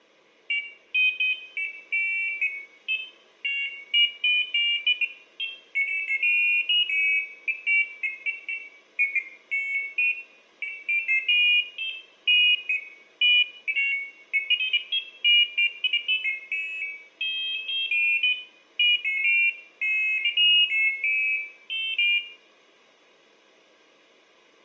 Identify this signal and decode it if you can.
Pairs of high tones at irregular times, with room echo. There is no code.